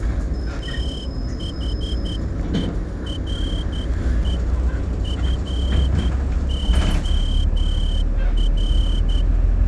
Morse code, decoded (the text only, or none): THERE FOR